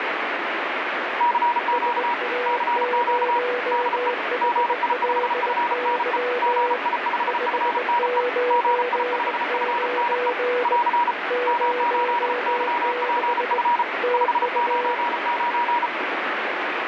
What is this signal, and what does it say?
Morse code, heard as two keyed tones, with heavy radio static. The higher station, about 34 wpm, 960 Hz: CQ CQ DE GI5FNE GI5FNE GI5FNE <AR> M8YPF 599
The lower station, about 20 wpm, 490 Hz: SA0HLY 599 06 TU